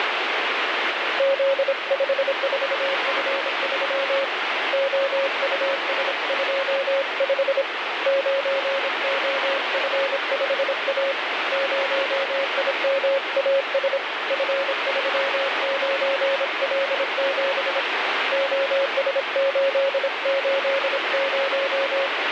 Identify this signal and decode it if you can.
Morse code, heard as a keyed tone, hand-sent with a paddle, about 26 wpm, 550 Hz, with heavy radio static. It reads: Z54F3 OUS25 9OF5A 0IMAS F39L7 OS880